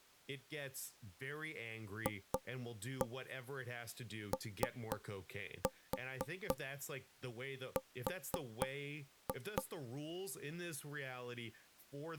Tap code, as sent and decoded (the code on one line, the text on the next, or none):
2-1 3-4 4-2
FOR